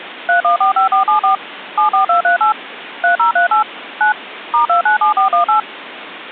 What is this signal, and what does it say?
DTMF, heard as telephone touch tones, dialled by machine, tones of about 120 ms, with phone line noise. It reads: 3145474 74238 3038 9 *297418